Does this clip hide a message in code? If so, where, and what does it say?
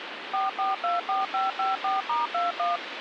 Yes: DTMF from 0.3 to 2.8 s, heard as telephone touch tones, dialled by machine, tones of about 160 ms, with phone line noise. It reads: 4424554*21